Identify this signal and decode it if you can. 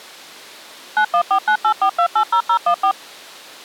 DTMF, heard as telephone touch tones, dialled by machine, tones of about 80 ms. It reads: 914984280014